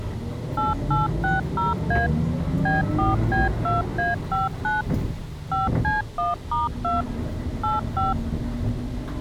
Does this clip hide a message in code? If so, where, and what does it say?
Yes: DTMF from 0.6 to 8.1 s, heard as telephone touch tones, dialled by machine, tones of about 160 ms, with the noise inside a bus. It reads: 8860A B4B2A59 5C1*2 85